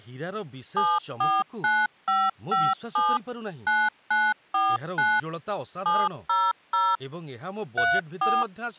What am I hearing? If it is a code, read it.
DTMF, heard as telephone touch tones, dialled by machine, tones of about 220 ms, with speech in Odia. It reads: 749557 9949 700 34